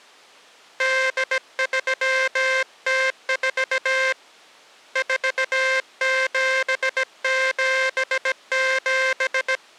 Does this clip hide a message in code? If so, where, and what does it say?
Yes: Morse code (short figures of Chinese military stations) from 0.7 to 9.6 s, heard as a buzzer, hand-sent with a bug key, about 17 wpm. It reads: 8304 4777